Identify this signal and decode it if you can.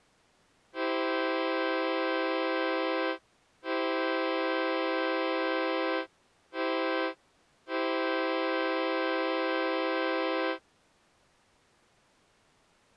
Train horn signal, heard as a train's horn. 2 long, 1 short, 1 long. On North American railways: approaching a public crossing.